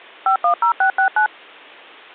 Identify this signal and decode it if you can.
DTMF, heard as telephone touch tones, dialled by machine, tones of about 100 ms. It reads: 510669